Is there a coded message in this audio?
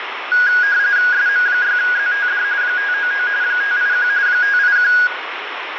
Yes: RTTY (45.45 baud, 170 Hz shift) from 0.3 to 5.1 s, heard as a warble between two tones, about 1550 Hz centre, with radio static and room echo. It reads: SM6ZTD 599 581 581